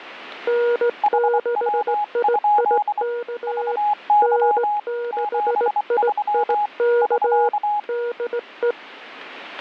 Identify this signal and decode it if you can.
Morse code, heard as two keyed tones. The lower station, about 18 wpm, 480 Hz: N6IIK N6IIK DE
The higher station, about 24 wpm, 830 Hz: HW? VY 73 <SK>